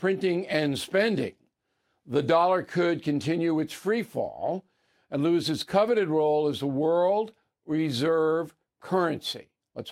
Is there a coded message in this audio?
No, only speech in English.